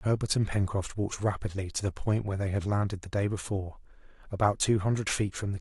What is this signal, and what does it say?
Speech in English. There is no code.